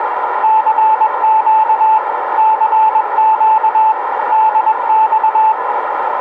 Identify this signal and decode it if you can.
Morse code, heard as a keyed tone, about 21 wpm, 880 Hz, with radio static and a narrow filter. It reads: CQ CQ DX